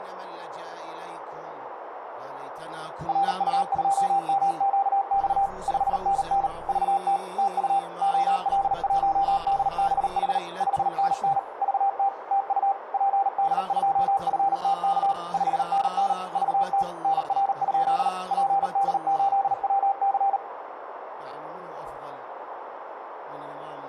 Morse code, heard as a keyed tone, machine-sent, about 38 wpm, 790 Hz, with radio static, a narrow filter and room echo. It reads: RU2MQX 5NN VT TU OL1DBH 5NN VT TU PD2FTK 5NN VT NR? PD8WC